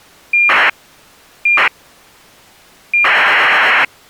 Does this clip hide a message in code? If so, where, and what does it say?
Yes: ACARS aircraft data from 0.3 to 3.9 s, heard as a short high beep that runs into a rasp, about 2400 baud.